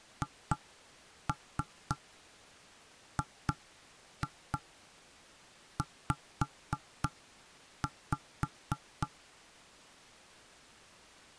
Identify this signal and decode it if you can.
Tap code, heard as knocks on wood, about 3 knocks a second. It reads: HGZ